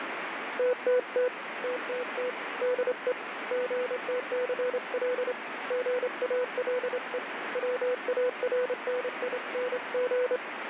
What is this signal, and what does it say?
Morse code, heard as a keyed tone, hand-sent with a straight key, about 27 wpm, 500 Hz, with radio static. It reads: TTT TTT DE GTCL GALE WARNING